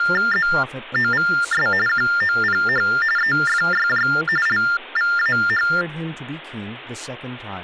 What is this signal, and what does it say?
TTY/TDD text telephone tones (45.45 baud Baudot), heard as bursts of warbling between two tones, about 400 Hz shift, 1600 Hz centre, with speech in English. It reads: ZOVS QOPH EFYJ LVAH